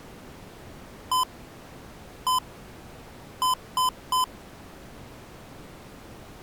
Beep code, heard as beeps from a small speaker, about 1020 Hz. 1-1-3. In Phoenix BIOS tables: CMOS read or write failure.